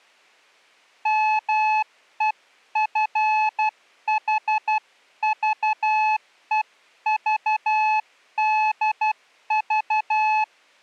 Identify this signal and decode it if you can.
Morse code (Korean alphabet), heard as a keyed tone, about 12 wpm, 860 Hz. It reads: 마누라를